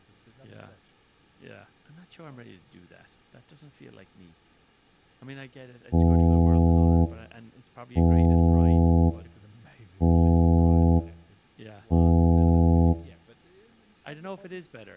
Ship horn signal, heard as a ship's horn, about 80 Hz, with speech in English. 4 short. At sea: a pilot vessel's identity signal in fog.